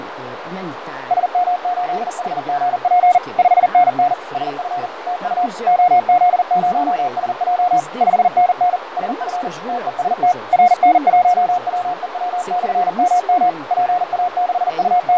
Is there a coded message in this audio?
Yes: Morse code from 1.0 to 15.2 s, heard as a keyed tone, machine-sent, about 40 wpm, 720 Hz, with radio static, fading and a narrow filter. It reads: SM8HGP 5NN SF TU OZ0SJ 5NN SF TEST RN1WEW/MM …